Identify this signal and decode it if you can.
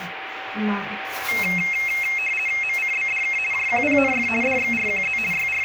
RTTY (50 baud, 450 Hz shift), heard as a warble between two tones, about 2350 Hz centre, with radio static, a steady whistle near 770 Hz and the noise inside a lift. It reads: MCBDK JQPNF DXRQZ …